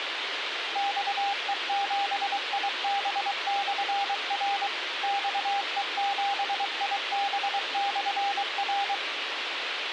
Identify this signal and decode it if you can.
Morse code, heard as a keyed tone, machine-sent, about 23 wpm, 800 Hz, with radio hiss. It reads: XE7IB/R XE7IB/R